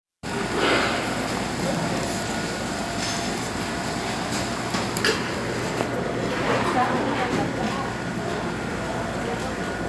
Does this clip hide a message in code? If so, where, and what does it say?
No, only the noise of a cafe.